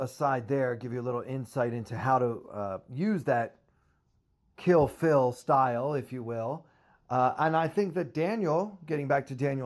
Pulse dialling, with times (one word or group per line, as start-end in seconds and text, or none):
none